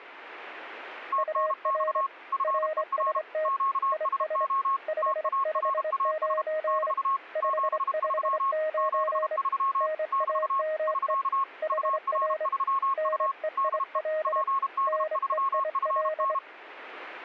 Morse code, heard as two keyed tones. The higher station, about 32 wpm, 1090 Hz: TNX FER QSO TARAS <BT> 73 73 <BT> <SK> UR3U DE PD3FN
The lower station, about 25 wpm, 620 Hz: UR RST IS 559 559 NAME HR NEIL NEIL